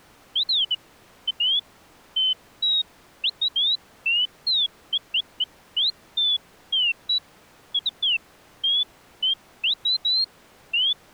Bird-like chirps. There is no code.